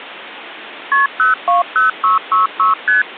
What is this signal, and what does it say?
Multi-frequency trunk signalling (R1, as on North American trunks), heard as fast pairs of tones, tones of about 140 ms. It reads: KP 020666 ST